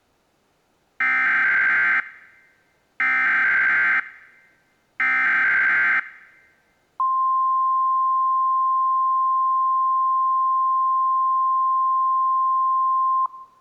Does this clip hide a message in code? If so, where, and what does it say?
Yes: Emergency Alert System (SAME) tones (header bursts, then the 1050 Hz attention tone) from 1.0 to 13.3 s, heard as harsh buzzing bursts, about 520.83 baud.